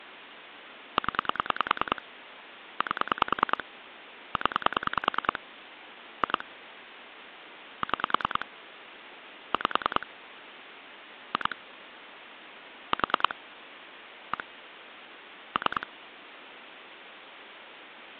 Pulse dialling, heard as clicks on a phone line, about 10 pulses a second. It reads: 0 8 0 2 6 5 2 4 1 3